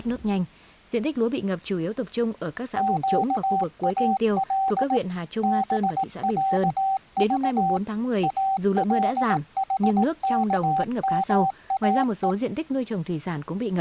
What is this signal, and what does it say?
Morse code (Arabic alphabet), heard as a keyed tone, machine-sent, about 18 wpm, 770 Hz, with speech in Vietnamese. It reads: قال بعض الحكماء